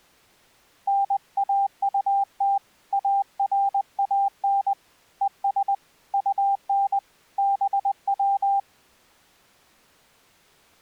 Morse code, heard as a keyed tone, hand-sent with a paddle, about 20 wpm, 790 Hz. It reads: NAUT ARAN ES UN BW